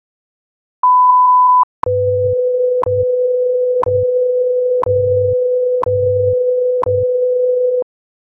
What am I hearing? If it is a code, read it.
Radio time signal (WWV, Colorado), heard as ticks, one a second.